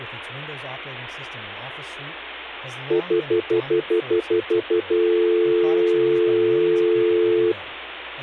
Telephone call progress tone (North American plan), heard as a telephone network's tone, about 350, 440 Hz, 0.1 s on and 0.1 s off, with speech in English. Stutter dial tone.